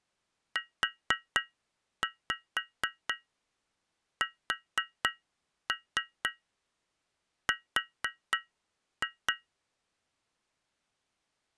Tap code, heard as taps on glass, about 4 knocks a second. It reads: USR